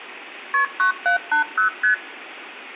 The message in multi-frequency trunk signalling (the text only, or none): KP 9780 ST